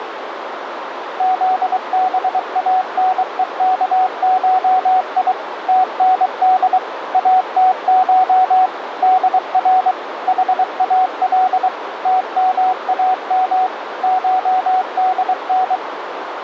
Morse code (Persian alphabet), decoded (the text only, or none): زبانهکشی تند اتش در حال تمام شدن